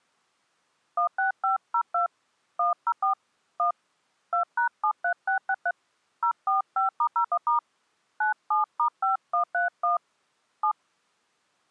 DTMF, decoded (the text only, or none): 16502 104 1 2#73663 045*01* 97*5131 7